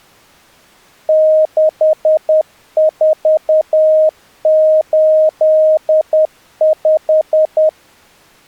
Morse code, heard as a keyed tone, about 10 wpm, 620 Hz. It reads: 6485